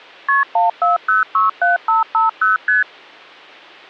Multi-frequency trunk signalling (R1, as on North American trunks), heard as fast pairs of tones, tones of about 150 ms. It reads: KP 14067550 ST